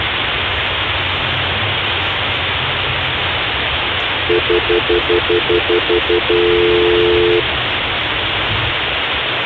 Telephone call progress tone (North American plan), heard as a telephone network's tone, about 350, 440 Hz, 0.1 s on and 0.1 s off, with phone line noise and the noise inside a car. Stutter dial tone.